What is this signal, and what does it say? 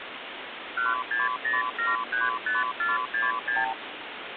Multi-frequency trunk signalling (R2, with the far end's replies), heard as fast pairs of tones, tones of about 170 ms, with phone line noise. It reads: 160735466